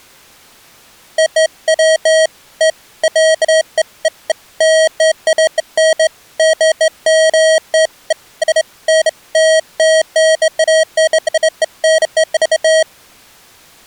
Beeps of irregular length. There is no code.